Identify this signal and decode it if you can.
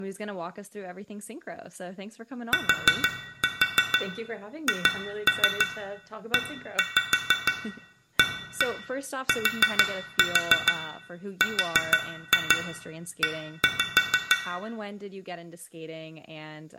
Tap code, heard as taps on glass, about 6 knocks a second, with room echo and speech in English. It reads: THEATRE